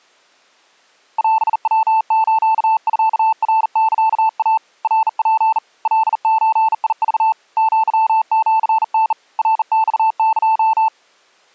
Morse code (Japanese Wabun code), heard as a keyed tone, hand-sent with a bug key, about 40 wpm, 880 Hz. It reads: オヤスミナサイ ナツ カゾク アシタ ナマエ